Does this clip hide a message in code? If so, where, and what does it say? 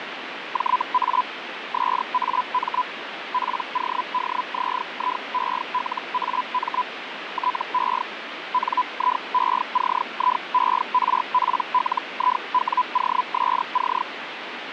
Yes: Hellschreiber (Feld-Hell, 122.5 baud) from 0.5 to 14.0 s, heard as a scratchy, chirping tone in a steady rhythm, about 1000 Hz, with radio static. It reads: JA SAM PODZIELAM TE NIECIERPLIWOSC